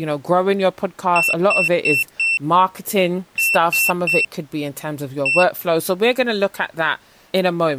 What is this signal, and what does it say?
Beep code, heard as a piezo beeper, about 2700 Hz, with speech in English. 4-3-1. In Phoenix BIOS tables: memory failure above the first 64 KB.